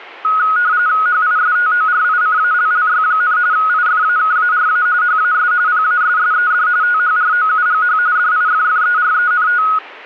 RTTY (45.45 baud, 170 Hz shift), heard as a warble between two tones, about 1360 Hz centre. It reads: HISTORICALLY, IFAKARA HAS PASSED THROUGH DIFFERENT